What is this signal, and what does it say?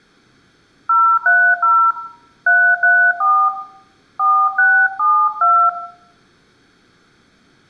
DTMF, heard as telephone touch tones, dialled by hand, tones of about 280 ms, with room echo. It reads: 030 334 4672